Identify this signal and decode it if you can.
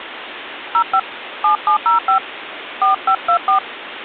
DTMF, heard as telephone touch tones, dialled by hand, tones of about 100 ms, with phone line noise. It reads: 05 7705 4524